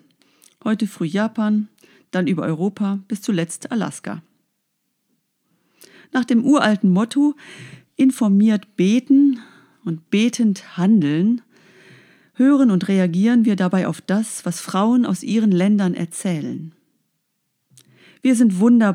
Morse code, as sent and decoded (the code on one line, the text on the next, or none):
none